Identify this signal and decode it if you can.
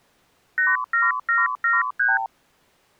Multi-frequency trunk signalling (R2, with the far end's replies), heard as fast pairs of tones, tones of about 180 ms. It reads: 87773